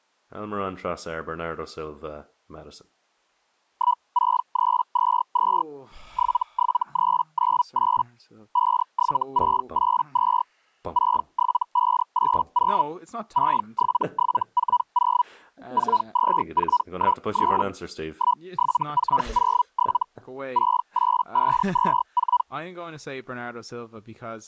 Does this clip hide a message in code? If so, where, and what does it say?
Yes: Hellschreiber (Feld-Hell, 122.5 baud) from 3.7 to 22.4 s, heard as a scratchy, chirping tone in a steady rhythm, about 980 Hz, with speech in English. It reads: 16322 77398 57682 67580 67740 42413 17407 68524